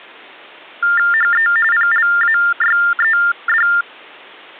TTY/TDD text telephone tones (45.45 baud Baudot), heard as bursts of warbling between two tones, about 400 Hz shift, 1600 Hz centre. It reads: HE PLAYED